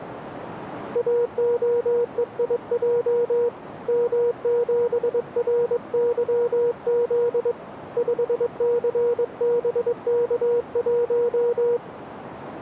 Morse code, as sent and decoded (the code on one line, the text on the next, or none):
.- --- . .. .--- / -- --... .-. -.-- --.. / ..... -.-. -... -.- .----
AOEIJ M7RYZ 5CBK1